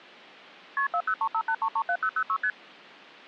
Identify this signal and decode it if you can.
Multi-frequency trunk signalling (R1, as on North American trunks), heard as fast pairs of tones, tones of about 70 ms. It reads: KP 40358337006 ST